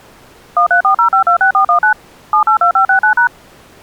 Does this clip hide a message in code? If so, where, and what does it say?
Yes: DTMF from 0.6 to 3.3 s, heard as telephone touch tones, dialled by machine, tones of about 100 ms. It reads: 1340526419 782569#